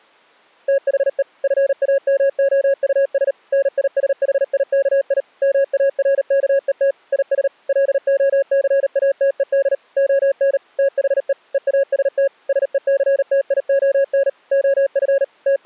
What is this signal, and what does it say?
Morse code, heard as a keyed tone, machine-sent, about 38 wpm, 550 Hz. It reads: THE FAMOUS NISHIKI MARKET IS LOCATED ON THE EAST SECTION OF …